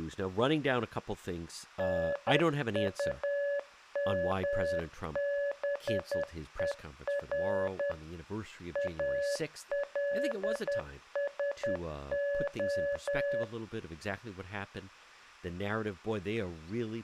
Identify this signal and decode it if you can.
Morse code, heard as a keyed tone, machine-sent, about 10 wpm, 570 Hz, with speech in English. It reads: NUMBER ALSO